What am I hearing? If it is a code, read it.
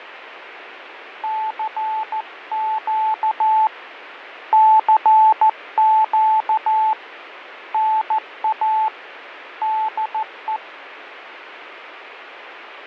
Morse code, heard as a keyed tone, hand-sent with a paddle, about 14 wpm, 870 Hz, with radio static and fading. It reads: CQ CQ NA DE